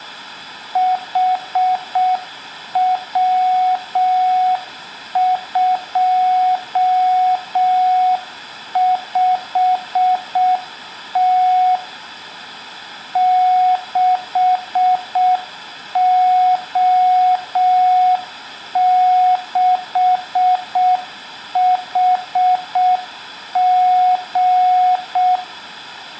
Morse code, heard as a keyed tone, machine-sent, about 6 wpm, 740 Hz, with room echo. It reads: HW25T 6O6HG